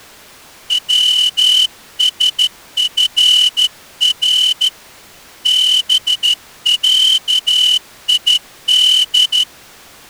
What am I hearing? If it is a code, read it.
Morse code (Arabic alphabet), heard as a whistle, hand-sent with a straight key, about 13 wpm. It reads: وسفر بعيد